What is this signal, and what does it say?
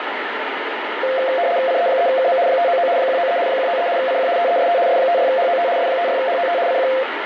RTTY (75 baud, 170 Hz shift), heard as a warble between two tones, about 610 Hz centre, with radio static. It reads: CE3KM 599 193 193 CQ TEST S56HOT S56HOT CQ